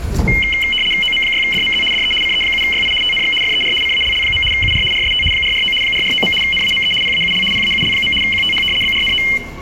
RTTY (75 baud, 850 Hz shift), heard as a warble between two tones, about 2550 Hz centre, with room echo and the noise of a subway station. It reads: OM6DMZ DE CE7YI TNX FER CALL. UR RST 449 449. NAME PAUL PAUL. QTH BRNO